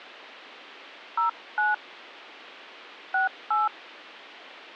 DTMF, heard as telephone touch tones, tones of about 150 ms. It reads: 09 68